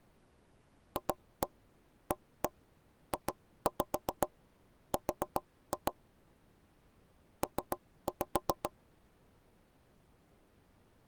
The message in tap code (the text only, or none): FAJR P